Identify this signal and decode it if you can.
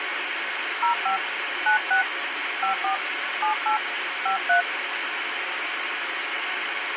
DTMF, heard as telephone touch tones, dialled by hand, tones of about 110 ms, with radio hiss. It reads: 05 96 54 78 53